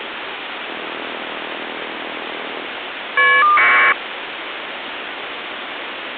Caller ID data burst, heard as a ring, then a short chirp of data, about 1200 baud, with phone line noise.